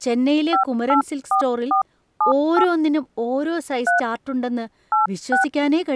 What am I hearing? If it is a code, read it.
DTMF, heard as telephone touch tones, dialled by hand, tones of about 120 ms, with speech in Malayalam. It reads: 584478 3 86